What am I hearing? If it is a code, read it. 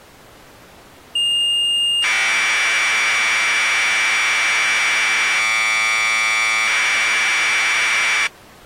Commodore tape loading (standard loader), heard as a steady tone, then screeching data.